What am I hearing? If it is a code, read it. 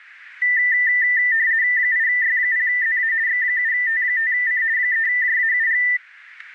RTTY (50 baud, 170 Hz shift), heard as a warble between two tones, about 1900 Hz centre, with static crashes. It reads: 8Y0ZA X7T5C 3JAUG